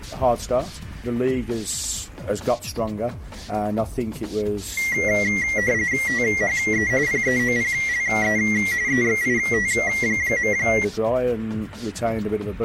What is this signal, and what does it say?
RTTY (45.45 baud, 170 Hz shift), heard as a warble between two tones, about 2050 Hz centre. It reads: THE PEOPLE EXIT.